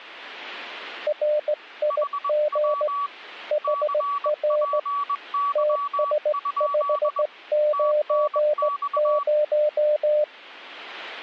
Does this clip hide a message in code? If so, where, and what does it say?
Yes: Morse code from 1.0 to 10.3 s, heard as two keyed tones. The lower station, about 17 wpm, 600 Hz: RIG HR TS590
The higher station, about 21 wpm, 1140 Hz: HW CPY? TNX